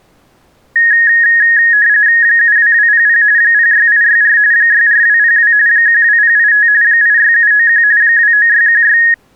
RTTY (45.45 baud, 170 Hz shift), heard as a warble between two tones, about 1750 Hz centre. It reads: 72200 06864 64202 12085 86791 29616